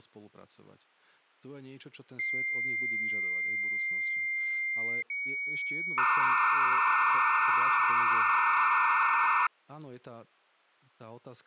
Dial-up modem handshake (low-speed, two carriers), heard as two whistles, then hiss, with speech in Slovak.